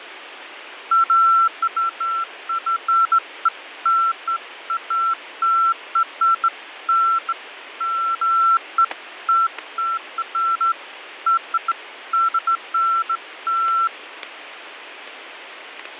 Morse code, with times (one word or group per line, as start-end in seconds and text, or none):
none